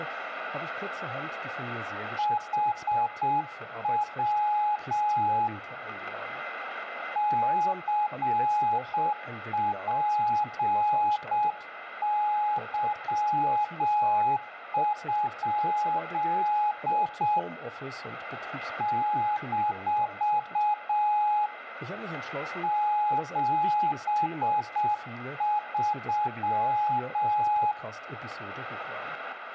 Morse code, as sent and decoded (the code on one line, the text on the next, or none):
.... .-- / -.-. .--. -.-- ..--.. / -....- / --... ...--
HW CPY? - 73